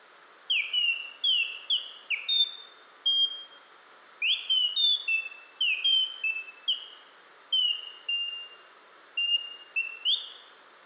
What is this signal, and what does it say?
Bird-like chirps, with room echo. There is no code.